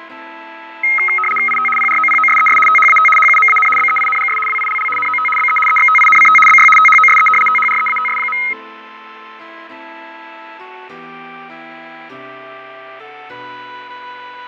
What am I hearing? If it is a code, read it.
RTTY (75 baud, 850 Hz shift), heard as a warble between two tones, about 1700 Hz centre, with fading. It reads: IT PROPOSES THAT HUMAN BEINGS WILL NOT BE EXTINCT BY THOSE THREATS.